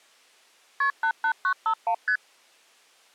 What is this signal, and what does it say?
Multi-frequency trunk signalling (R1, as on North American trunks), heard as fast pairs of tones, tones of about 80 ms. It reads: KP 88951 ST